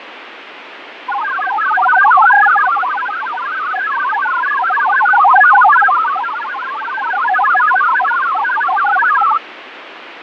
Multi-tone FSK (Olivia or MFSK type), about 1000 Hz wide, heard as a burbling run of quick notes, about 62.5 baud, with radio static and fading.